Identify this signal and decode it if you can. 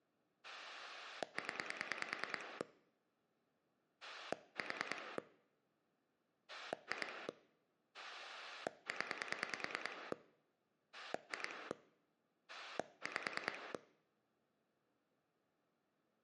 Pulse dialling, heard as a rotary dial, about 9 pulses a second. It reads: 0 4 2 0 2 5